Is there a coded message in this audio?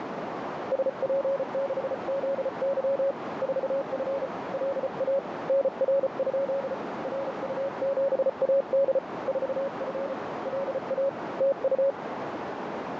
Yes: Morse code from 0.7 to 12.0 s, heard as a keyed tone, hand-sent with a paddle, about 34 wpm, 550 Hz, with heavy radio static and a narrow filter. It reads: SP6ZY 4F LA NR? RU7AD 4F LA TU